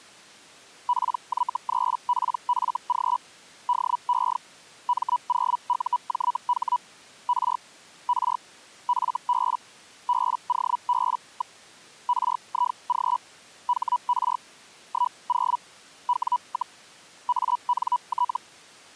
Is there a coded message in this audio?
Yes: Hellschreiber (Feld-Hell, 122.5 baud) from 0.9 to 18.4 s, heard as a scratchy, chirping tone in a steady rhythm, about 980 Hz. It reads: PY3PFG DE M0UJH R R FB BOB. RIG HR 10 W, ANT